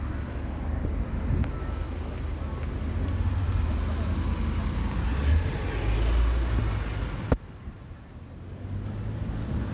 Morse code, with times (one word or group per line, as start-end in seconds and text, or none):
none